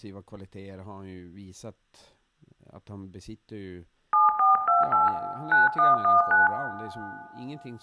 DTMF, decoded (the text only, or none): 7428 9119